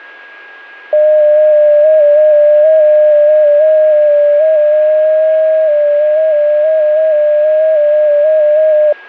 FT8 (one signal), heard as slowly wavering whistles, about 6.25 baud, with a steady whistle near 1640 Hz.